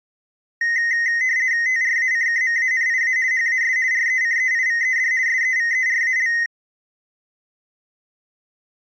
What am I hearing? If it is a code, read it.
RTTY (50 baud, 170 Hz shift), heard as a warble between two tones, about 1950 Hz centre. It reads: TRACKMANIA HAS RECEIVED SEVERAL